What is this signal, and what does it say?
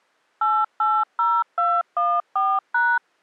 DTMF, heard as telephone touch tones, dialled by machine, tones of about 240 ms. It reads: 880214#